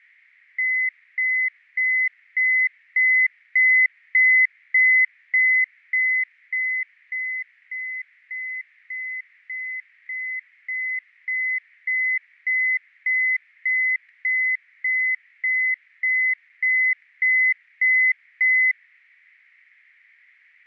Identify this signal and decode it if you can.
Evenly repeated beeps, with fading. There is no code.